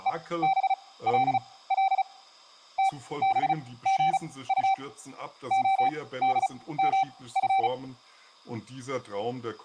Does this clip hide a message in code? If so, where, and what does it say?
Yes: Morse code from 0.0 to 7.7 s, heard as a keyed tone, machine-sent, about 35 wpm, spaced as for 19 wpm, 770 Hz, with speech in German. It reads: EBLL TBGU ODMF